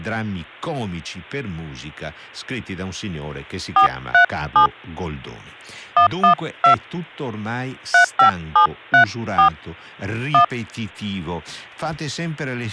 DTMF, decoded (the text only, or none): 437 112 35734 1